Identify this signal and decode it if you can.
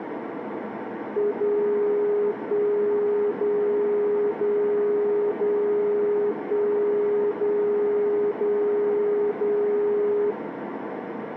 Radio time signal (DCF77), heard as a tone whose level steps once a second, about 410 Hz, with radio static and a narrow filter. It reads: 0 1 0 0 0 1 0 0 0